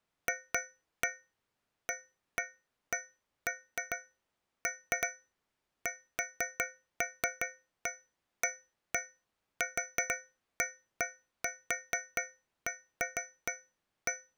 Irregular taps on a metal pipe. There is no code.